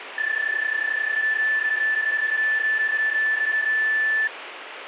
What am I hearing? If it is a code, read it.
PSK31 (31.25 baud), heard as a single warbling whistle, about 1750 Hz, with radio static.